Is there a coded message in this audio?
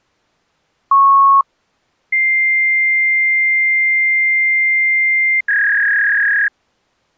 Yes: fax machine handshake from 0.9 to 6.5 s, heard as a beep, a long tone and a warble.